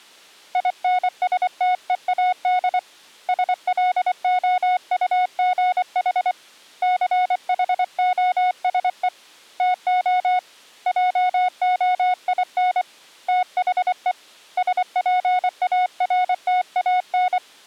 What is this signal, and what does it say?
Morse code, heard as a keyed tone, hand-sent with a paddle, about 24 wpm, 730 Hz. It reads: INSTEAD SLOUGH CHOSE TO JOIN THE SPARTAN